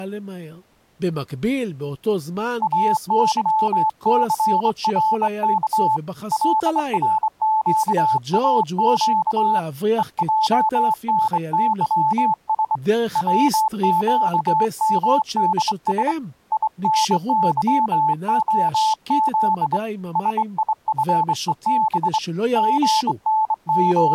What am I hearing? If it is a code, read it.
Morse code, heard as a keyed tone, hand-sent with a straight key, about 24 wpm, 870 Hz, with speech in Hebrew. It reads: AYCRK LRQAQ EJNYS WQMDS INYOZ SIFEB …